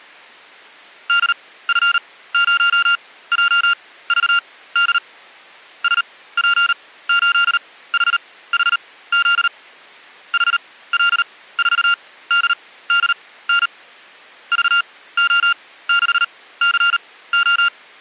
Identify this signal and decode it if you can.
Morse code, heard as electronic beeps, machine-sent, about 38 wpm, spaced as for 18 wpm, 1400 Hz. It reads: DF0JVD SP8HHZ HL4DDN VO6CO